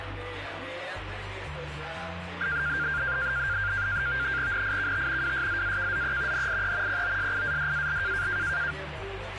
NAVTEX (SITOR-B), 100 baud, 170 Hz shift, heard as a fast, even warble, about 1500 Hz centre, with radio static. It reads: NIKT WSZAKZE NIE POSIADAL